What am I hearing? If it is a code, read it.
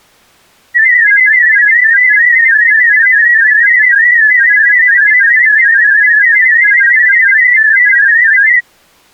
Multi-tone FSK (Olivia or MFSK type), about 500 Hz wide, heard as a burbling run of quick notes, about 31.25 baud.